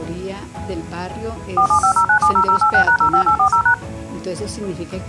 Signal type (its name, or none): DTMF